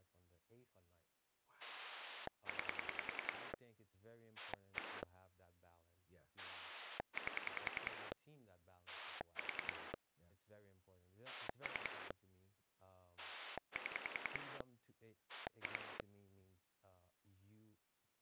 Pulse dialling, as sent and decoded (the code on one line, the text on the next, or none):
9 / 1 / 8 / 4 / 3 / 7 / 2
9 1 8 4 3 7 2